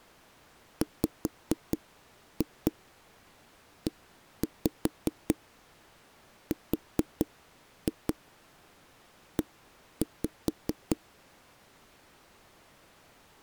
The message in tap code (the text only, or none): WERE